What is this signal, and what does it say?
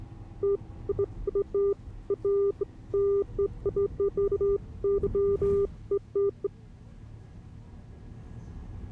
Beeps of irregular length, with the noise inside a bus. There is no code.